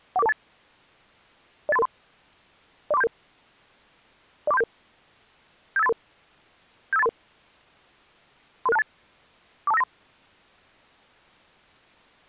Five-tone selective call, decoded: 14428 08333 04377 04377 75833 75833 33628 42593

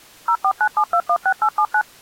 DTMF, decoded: 0497216879

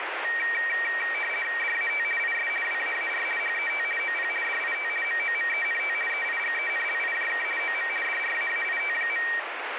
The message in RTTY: DAT IS WAAR HET OP DIT MOMENT EIGENLIJK OM DRAAIT.

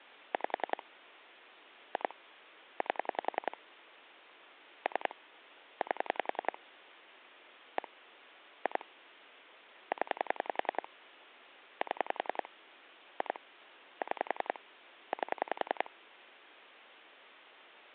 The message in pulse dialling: 5 2 8 3 8 1 2 0 7 2 6 8

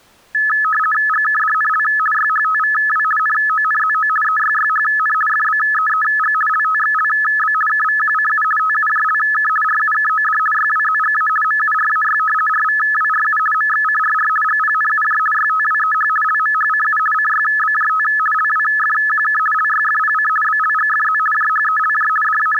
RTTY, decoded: GKDNL YHTVW NONZO EYYHN FBEEG LTXLB KVQCU TUJLK RUKOD YWZGA MURAY RVWRU MXCRR GPNUJ YTWEH LMHCU CYBJT LWFQK LYFPC BLGFZ JHELJ …

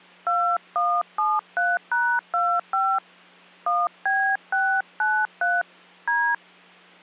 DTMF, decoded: 2173#25 1B693 D

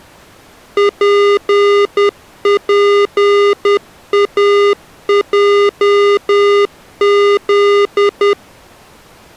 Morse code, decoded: PPAJZ

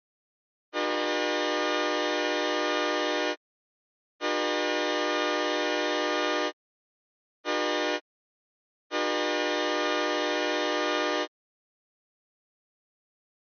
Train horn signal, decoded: 2 long, 1 short, 1 long

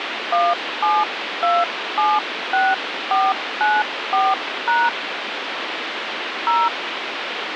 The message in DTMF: 17276494# 0

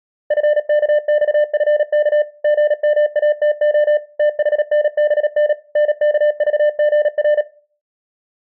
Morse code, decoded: FKXFK GMATO THNBN NKVGR

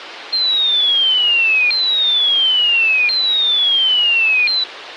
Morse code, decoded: none

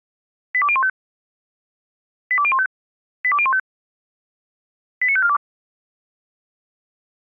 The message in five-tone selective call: 82015 82015 82015 89542

